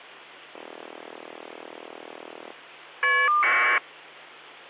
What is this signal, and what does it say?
Caller ID data burst, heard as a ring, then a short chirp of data, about 1200 baud, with hum.